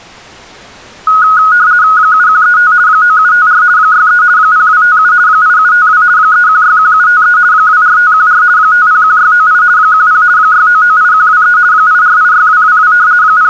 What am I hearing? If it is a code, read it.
RTTY (50 baud, 170 Hz shift), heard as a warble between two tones, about 1360 Hz centre. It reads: 7135 9754 63 0257 8752 3161753 24514 501698 10 6998123 8486222 …